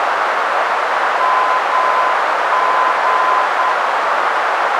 Morse code, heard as a keyed tone, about 9 wpm, 1020 Hz, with heavy radio static and a narrow filter. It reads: MG